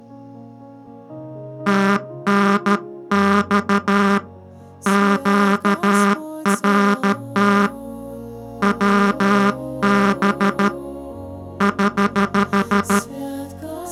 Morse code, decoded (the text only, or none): TNX QRT WB <HH>